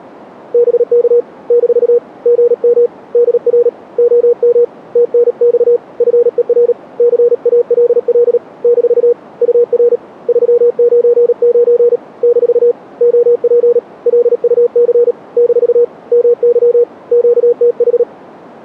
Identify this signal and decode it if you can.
Morse code, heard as a keyed tone, hand-sent with a paddle, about 37 wpm, 480 Hz. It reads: BK - GM DR OM TNX FER CALL - UR 399 - OP LUC - MY QTH